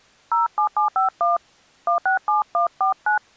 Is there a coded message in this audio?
Yes: DTMF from 0.3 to 3.2 s, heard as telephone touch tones, dialled by hand, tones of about 120 ms. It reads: 07751 167149